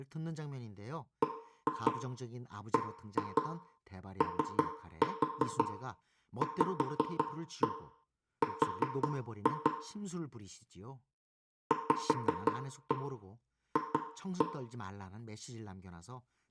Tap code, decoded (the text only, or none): BBOVR VF